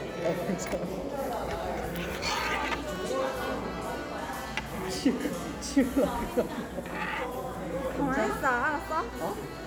The noise of a cafe. There is no code.